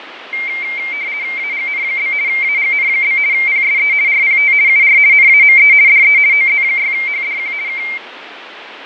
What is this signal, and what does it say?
RTTY (50 baud, 170 Hz shift), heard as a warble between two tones, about 2200 Hz centre, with radio static and fading. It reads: AGN? AGN? PSE RPT UR NAME DE OZ6HDQ K